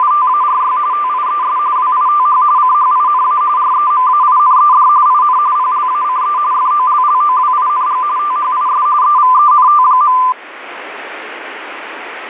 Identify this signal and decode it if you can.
RTTY (45.45 baud, 170 Hz shift), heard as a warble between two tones, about 1100 Hz centre, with radio static. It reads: … TIES WITH CHINA REMAINED IN PLACE FOLLOWING THIS EVENT.